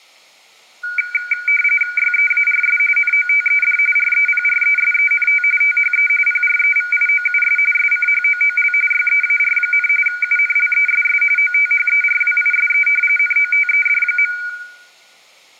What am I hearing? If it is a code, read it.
RTTY (45.45 baud, 850 Hz shift), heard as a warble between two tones, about 1850 Hz centre, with room echo. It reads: YEARS NOTED REPRESENT THE PREVIOUS SCHOOL YEAR, UNLESS OTHERWISE NOTED.